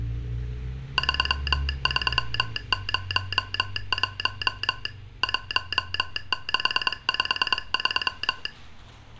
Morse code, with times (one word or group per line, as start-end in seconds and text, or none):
1.0-4.9 3301
5.2-8.5 1653